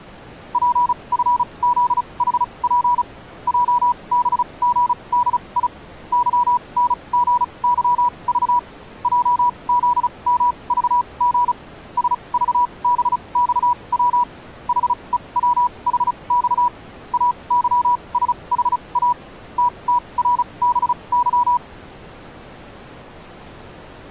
Morse code, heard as a keyed tone, machine-sent, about 35 wpm, spaced as for 26 wpm, 980 Hz. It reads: PFZHP JBGDI YNGYV JZMVG SVBXW HEWHX AYSHA TTRBY